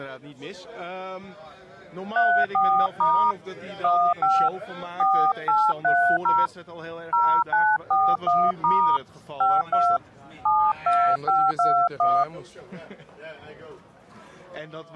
DTMF, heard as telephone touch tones, dialled by hand, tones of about 250 ms. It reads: 34* 15 4830 0941* 52 72521